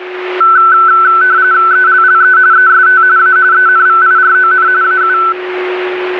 RTTY (45.45 baud, 170 Hz shift), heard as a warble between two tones, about 1420 Hz centre, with radio static and a steady whistle near 370 Hz. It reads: ELLE EST A ENVIRON AU